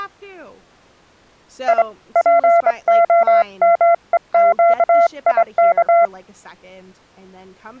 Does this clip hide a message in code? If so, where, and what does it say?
Yes: Morse code (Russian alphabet) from 1.6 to 6.1 s, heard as a keyed tone, hand-sent with a straight key, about 24 wpm, 680 Hz, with speech in English. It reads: И ПОМЕЩИК